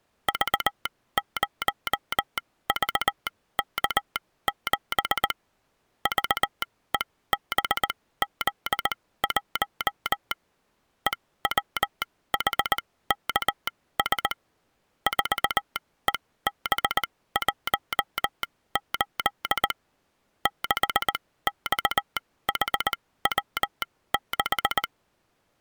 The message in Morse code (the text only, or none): V0VK7 VEBZ1 EWHKS 4EB18 6XHW6